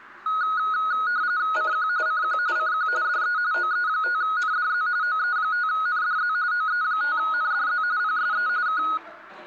RTTY (45.45 baud, 170 Hz shift), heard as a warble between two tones, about 1360 Hz centre, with the noise of a cafe. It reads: CQ CQ CQ DE OE5NDZ OE5NDZ OE5NDZ PSE K